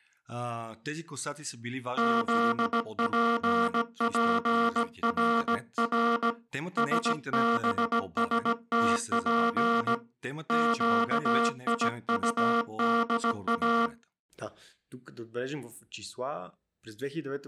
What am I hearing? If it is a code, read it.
Morse code (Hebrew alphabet), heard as a buzzer, hand-sent with a paddle, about 17 wpm, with speech in Bulgarian. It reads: זפפרר שבשתף קיטדא